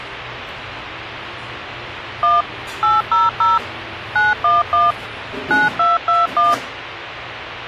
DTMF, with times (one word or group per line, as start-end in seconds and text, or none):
2.2-2.4 1
2.8-3.6 800
4.2-4.9 911
5.5-6.5 9221